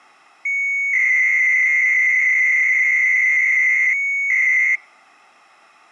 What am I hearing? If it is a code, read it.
300-baud modem data (Bell 103 tones), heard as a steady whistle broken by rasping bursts, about 300 baud, 200 Hz shift.